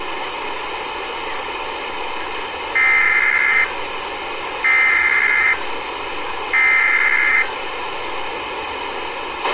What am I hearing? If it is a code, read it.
Emergency Alert System (SAME) tones (header bursts), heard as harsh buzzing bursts, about 520.83 baud, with radio hiss, a squelch burst at the end and street noise.